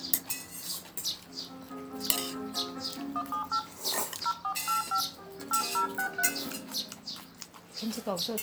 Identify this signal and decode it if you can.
DTMF, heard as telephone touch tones, dialled by hand, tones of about 100 ms, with room echo and the noise of a restaurant. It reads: 178 0485 8063